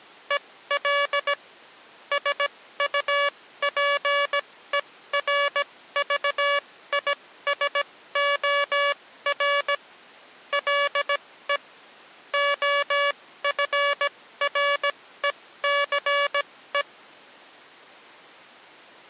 Morse code, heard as electronic beeps, machine-sent, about 17 wpm, spaced as for 14 wpm, 570 Hz. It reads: EL SUPERVISOR LE OFRECE